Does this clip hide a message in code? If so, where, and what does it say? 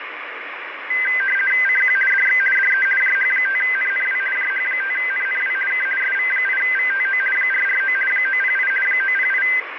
Yes: RTTY (50 baud, 450 Hz shift) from 0.9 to 9.6 s, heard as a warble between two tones, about 1800 Hz centre, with radio static. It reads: CQ DX DE JH5NNW JH5NNW K SV8VTO 449 908 908